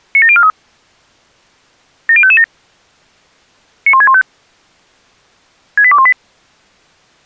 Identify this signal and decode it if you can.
Five-tone selective call (ZVEI), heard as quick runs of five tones, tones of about 70 ms. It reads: 97043 70557 91615 68218